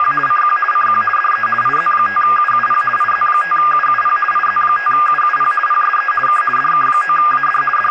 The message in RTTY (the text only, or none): … CQ CQ DE IZ5UUP IZ5UUP IZ5UUP PSE K DK9AD …